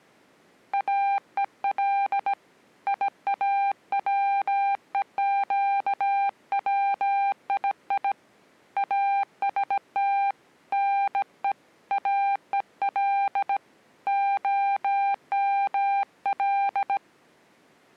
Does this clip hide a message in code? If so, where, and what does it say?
Yes: Morse code (Persian alphabet) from 0.7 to 17.0 s, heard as a keyed tone, hand-sent with a bug key, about 17 wpm, 800 Hz. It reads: اهل یاوهگویی است نه اهل عمل